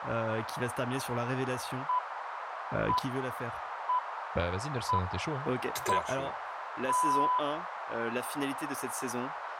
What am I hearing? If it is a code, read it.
Radio time signal (six pips, as the Greenwich Time Signal), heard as pips, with radio static, a narrow filter and speech in French.